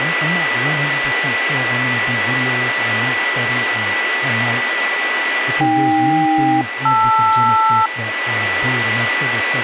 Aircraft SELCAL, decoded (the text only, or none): AK-LR